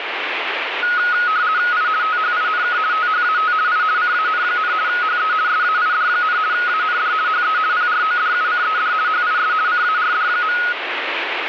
RTTY (50 baud, 170 Hz shift), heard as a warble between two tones, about 1360 Hz centre, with radio static. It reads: I THINK THAT I CAN, HE SAID, AND HE PRODUCED HIS CARD.